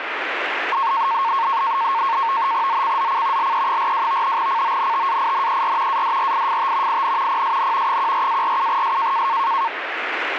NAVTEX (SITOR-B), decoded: ZCZC LE42 CONTAINER ADRIFT IN PSN 14-47S

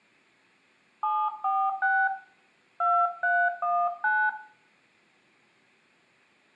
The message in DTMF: 746 2319

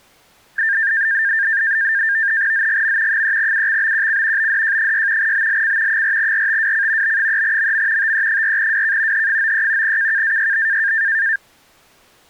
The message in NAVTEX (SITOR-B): ZGM 3UXBQC BDJ6 BLC 4RTWC B3MM TE4WK H93 KKAYB

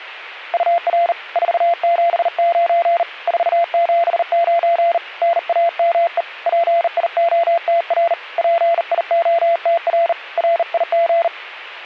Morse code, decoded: UR 479 479 NAME PIOTR PIOTR RIG

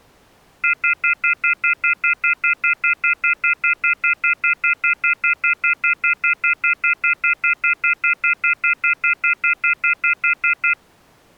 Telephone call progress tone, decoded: off-hook warning tone

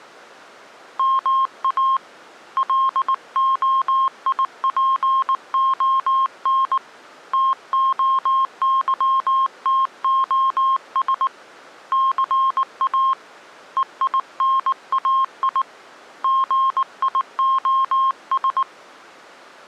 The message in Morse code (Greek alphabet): ΜΑ ΛΟΙΠΟΝ ΤΟΥΤΟΣ ΘΑ ΕΙΝΑΙ ΓΙΟΣ

